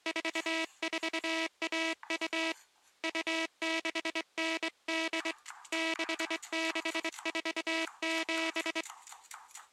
Morse code (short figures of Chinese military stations), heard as a buzzer, hand-sent with a straight key, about 23 wpm, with kitchen noise. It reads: 4412 2698 6647